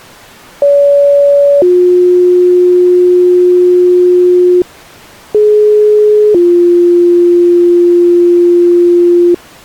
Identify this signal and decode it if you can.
Two-tone page, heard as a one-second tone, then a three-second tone, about 570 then 360 Hz, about 420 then 350 Hz.